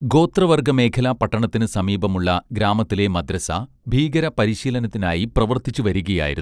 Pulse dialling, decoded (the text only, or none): none